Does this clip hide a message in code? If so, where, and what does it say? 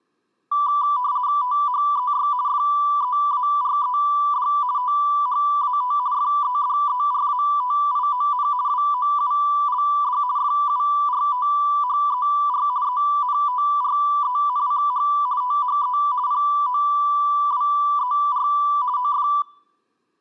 Yes: RTTY (50 baud, 170 Hz shift) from 0.5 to 19.4 s, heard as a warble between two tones, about 1080 Hz centre. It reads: THEY FEARED THAT FEDERATION WOULD FURTHER ENTRENCH THE POWER OF